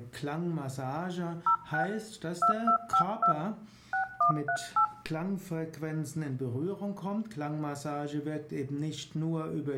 DTMF, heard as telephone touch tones, dialled by hand, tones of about 90 ms. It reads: 06 2252 6138